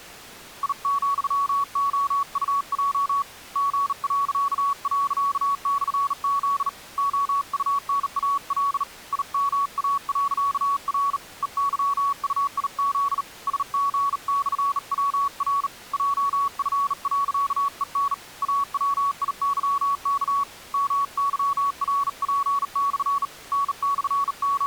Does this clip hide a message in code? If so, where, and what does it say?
Yes: Morse code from 0.6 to 24.7 s, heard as a keyed tone, hand-sent with a bug key, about 38 wpm, 1120 Hz. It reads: I,OUJ G../Z OUNAL IMA.R EYUIZ SG/WR JF.EN AWIYK MYRP/ …